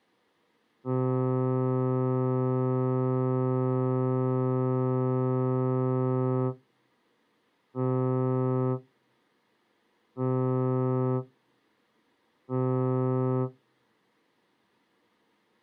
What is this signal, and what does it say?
Ship horn signal, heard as a ship's horn, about 130 Hz. 1 long, 3 short. At sea: a vessel under tow in fog.